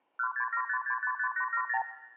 Multi-frequency trunk signalling (R2, with the far end's replies), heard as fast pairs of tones, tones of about 80 ms, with room echo. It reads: 1675655870